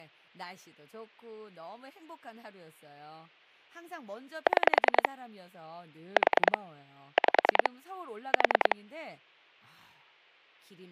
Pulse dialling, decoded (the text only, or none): 6 4 5 4